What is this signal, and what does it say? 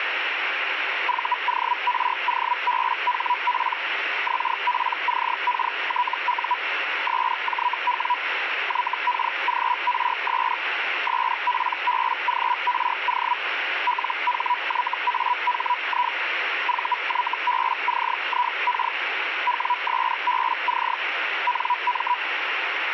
Hellschreiber (Feld-Hell, 122.5 baud), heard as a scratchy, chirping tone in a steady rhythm, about 980 Hz, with radio static. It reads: VOROBHP XPCKTU SJW YKGRS SPBGRO LHYAHI VYBCIK WSBC NM